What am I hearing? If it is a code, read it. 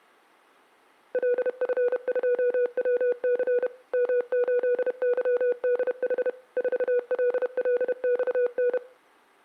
Morse code, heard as a keyed tone, machine-sent, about 31 wpm, 490 Hz, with room echo. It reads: LF2WC M8YDH 4LLXN